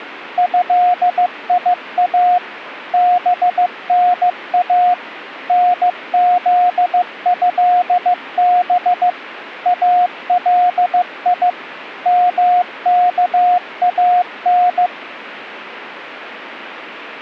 Morse code (Arabic alphabet), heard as a keyed tone, machine-sent, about 15 wpm, 720 Hz. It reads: هيا بنا نذهب الي مكان